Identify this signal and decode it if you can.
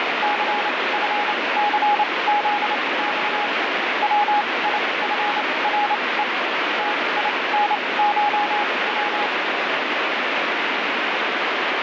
Morse code (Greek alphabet), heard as a keyed tone, machine-sent, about 28 wpm, spaced as for 21 wpm, 830 Hz, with heavy radio static. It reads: ΘΦΘΖΞ ΩΙΦΡΕ ΤΙΝΧΩ